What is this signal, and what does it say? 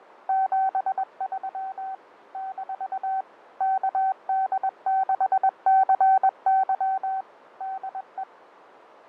Morse code, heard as a keyed tone, machine-sent, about 21 wpm, 770 Hz, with radio static and fading. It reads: 73 - KD6CY DE